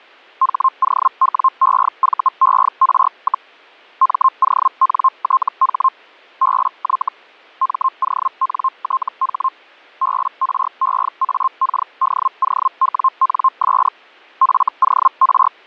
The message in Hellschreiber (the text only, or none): HOWEVER, MONTH BY MONTH BREAKDOWNS FOR